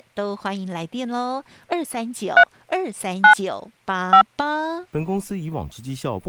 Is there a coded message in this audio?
Yes: DTMF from 2.4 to 4.2 s, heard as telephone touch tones, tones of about 90 ms, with speech in Chinese. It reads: 3 9 5